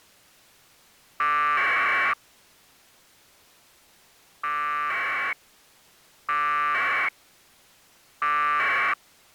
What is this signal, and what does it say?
Packet radio (AX.25, as in APRS), 1200 baud, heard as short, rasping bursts.